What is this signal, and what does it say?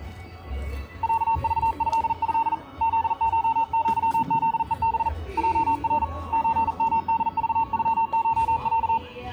Morse code (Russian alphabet), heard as a keyed tone, hand-sent with a paddle, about 40 wpm, 910 Hz, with the noise of a park. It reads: ЯЖЭЭ ЗШЪЗЕБ ЙР ЧМДЖЮШЯ